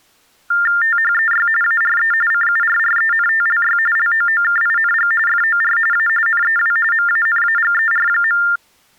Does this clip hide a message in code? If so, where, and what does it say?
Yes: TTY/TDD text telephone tones (45.45 baud Baudot) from 0.5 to 8.6 s, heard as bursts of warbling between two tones, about 400 Hz shift, 1600 Hz centre. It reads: THEY ARE CURRENTLY LOOKING FOR A NEW MANAGER.